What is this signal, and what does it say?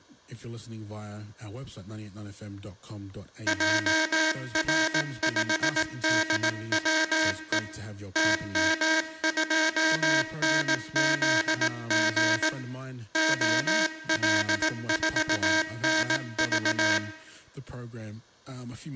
Morse code, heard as a buzzer, hand-sent with a paddle, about 18 wpm, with room echo. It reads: JR5DWE TM2NZG OL4NV